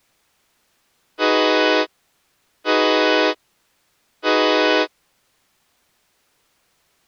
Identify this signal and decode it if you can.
Train horn signal, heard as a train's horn. 3 short. On North American railways: when stopped, the train will back up.